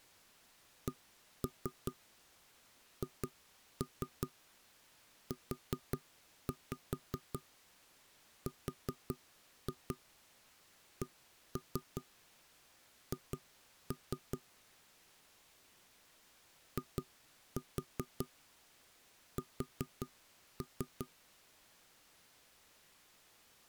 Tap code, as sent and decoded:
1-3 2-3 4-5 4-2 1-3 2-3 / 2-4 4-3
CHURCH IS

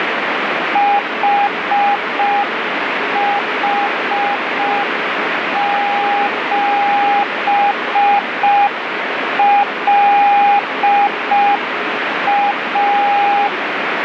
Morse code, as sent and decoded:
.... .... --... .-.. .-
HH7LA

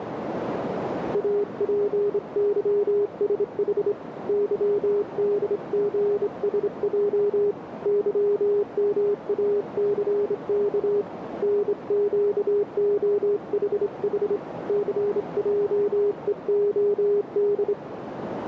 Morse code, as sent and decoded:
.- .--. -.-- ... .... / -.-- -.. --. ... .--- / -.-- -- .- -.-. -.- / -. --.- --- .... .... / -.-. .--- . --- -..
APYSH YDGSJ YMACK NQOHH CJEOD

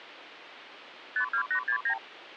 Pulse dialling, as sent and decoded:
none

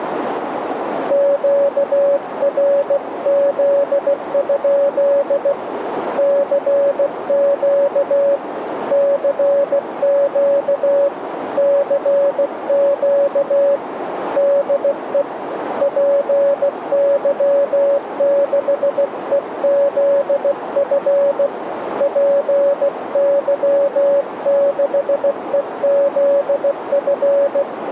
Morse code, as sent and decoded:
--.- .-. --.. ..--.. / -.-. --.- / -.-. --.- / -.-. --.- / -.. . / .--. -.-- -.... . --.. ..-. / .--. -.-- -.... . --.. ..-.
QRZ? CQ CQ CQ DE PY6EZF PY6EZF

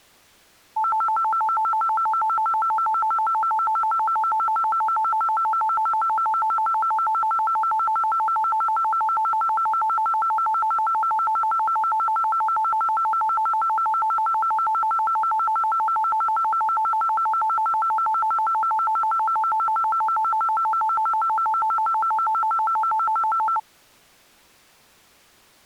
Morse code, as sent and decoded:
none

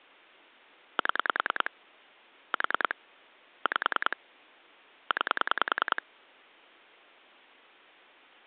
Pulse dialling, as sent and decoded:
7 / 4 / 5 / 9
7 4 5 9

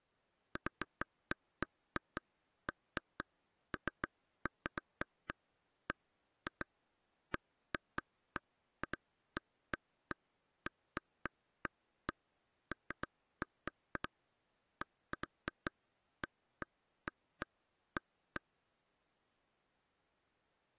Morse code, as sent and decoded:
none

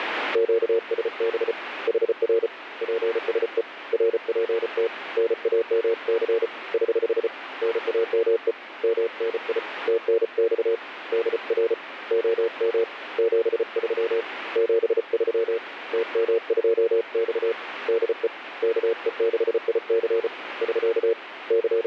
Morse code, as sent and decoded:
--.- ... -... / .... .-. / .--. ... . / .-. .--. - / -. .- -- -.-. / ........ / -. .- -- . / -- -. .. / - -. -..- / -.. .-. / --- -- / --... ...-- / --... ...-- / - -- ..--- -..- / -.. . / -.- . -.... .. -.-. / ...-.- / …
QSB HR PSE RPT NAMC <HH> NAME MNI TNX DR OM 73 73 TM2X DE KE6IC <SK> …

